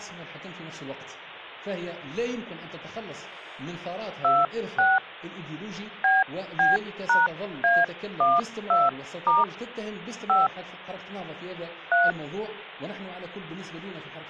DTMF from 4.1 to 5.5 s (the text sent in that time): 26